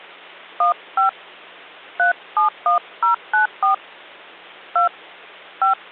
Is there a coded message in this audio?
Yes: DTMF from 0.6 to 5.7 s, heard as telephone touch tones, dialled by hand, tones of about 120 ms, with hum. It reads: 15 371094 2 5